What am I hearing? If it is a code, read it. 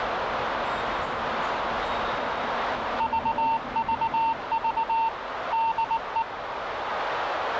Morse code, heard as a keyed tone, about 19 wpm, 910 Hz, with radio static, a narrow filter and the noise of a subway station. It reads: VVV DE